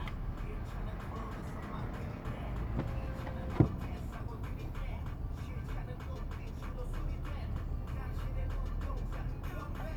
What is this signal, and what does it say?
The noise inside a car. There is no code.